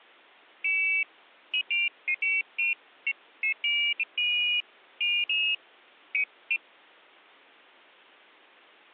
Pairs of high tones at irregular times. There is no code.